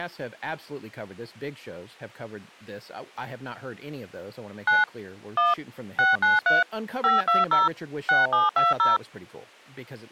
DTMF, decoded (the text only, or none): 9 1 693 520 6720